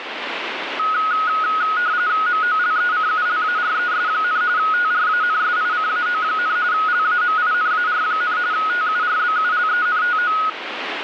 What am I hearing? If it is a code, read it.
RTTY (45.45 baud, 170 Hz shift), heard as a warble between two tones, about 1360 Hz centre, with radio static. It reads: MOLECULARES, TRANSICAO, LAMINAR, TURBULENTO